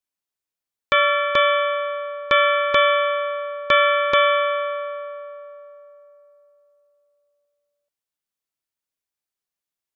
Ship's bell, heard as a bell. 6. Six half-hours of the watch have passed.